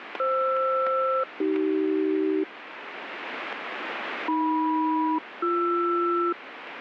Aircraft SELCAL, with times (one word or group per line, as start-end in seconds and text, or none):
0.2-2.4 FR-AC
4.3-6.3 AM-BR